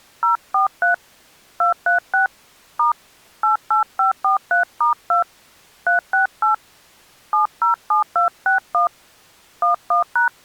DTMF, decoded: 043 236 * 88543*2 368 707261 11#

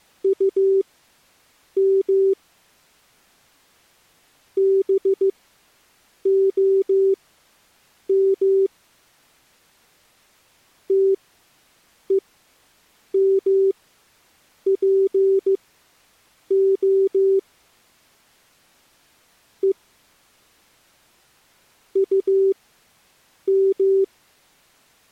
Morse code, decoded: UM BOM TEMPO E UM

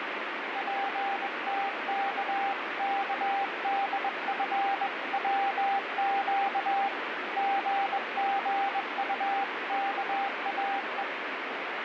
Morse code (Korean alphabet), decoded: 정은배 씨와

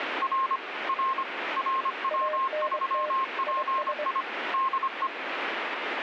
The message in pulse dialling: none

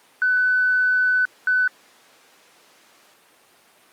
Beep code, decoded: 1 long, 1 short

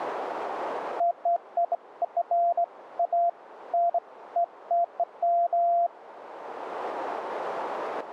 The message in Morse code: none

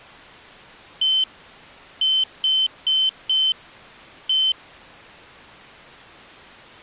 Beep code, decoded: 1-4-1

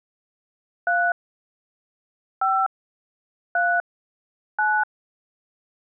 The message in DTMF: 3 5 3 9

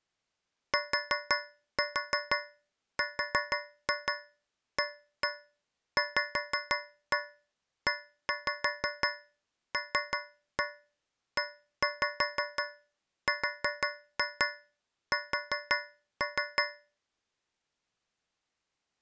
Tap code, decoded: TRAVELERS

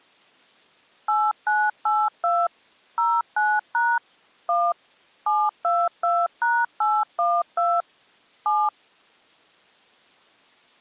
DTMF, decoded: 8982 09# 1 722#812 7

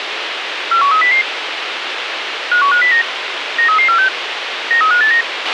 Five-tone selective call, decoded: 41300 51509 93346 93589

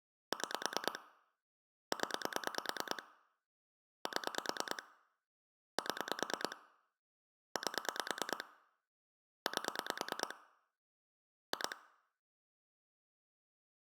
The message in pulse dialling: 6 0 7 7 8 8 2

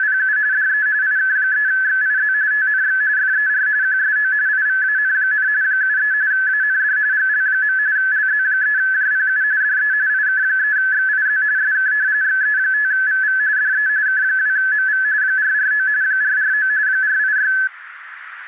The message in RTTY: … DE IK3XIZ TNX FER QSO IVAN, 73 AND GL. LZ3JPU DE IK3XIZ SK XE5VV DE K2MV 449 449 486

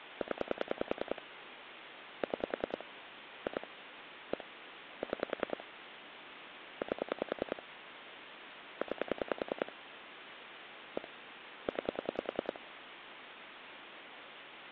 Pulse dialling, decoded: 0 6 2 1 6 8 9 1 9

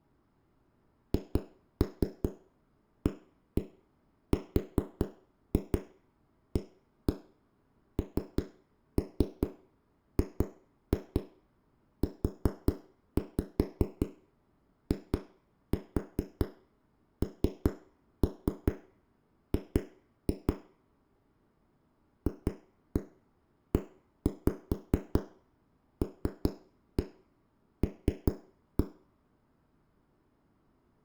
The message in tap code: HARANGUING FELL

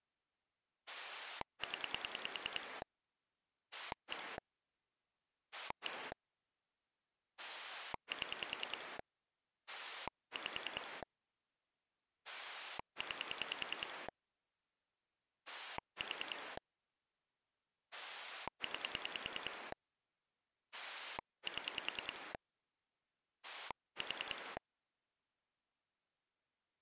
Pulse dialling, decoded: 0 1 1 7 5 9 4 9 7 4

